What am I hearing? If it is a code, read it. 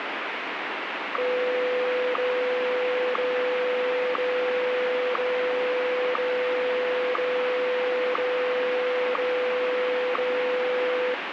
Radio time signal (WWVH, Hawaii), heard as ticks, one a second, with radio static.